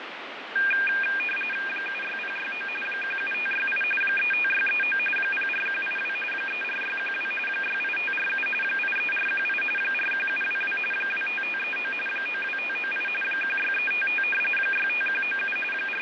RTTY (45.45 baud, 850 Hz shift), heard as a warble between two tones, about 2000 Hz centre, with radio static and fading. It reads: 76069 17568 35639 04182 34612 68547 83418 41722 25539 92598 16355 65197 …